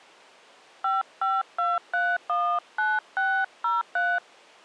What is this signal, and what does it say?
DTMF, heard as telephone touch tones, dialled by hand, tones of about 220 ms. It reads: 552319603